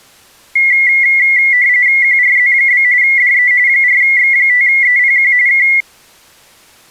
RTTY (45.45 baud, 170 Hz shift), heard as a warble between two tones, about 2050 Hz centre. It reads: QRZ? DE 4X5EPQ K